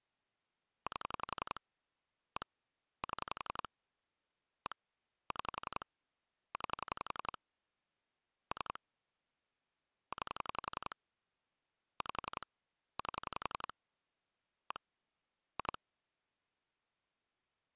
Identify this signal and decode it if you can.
Pulse dialling, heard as clicks on a phone line, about 11 pulses a second. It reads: 8 1 7 1 6 9 3 9 5 8 1 2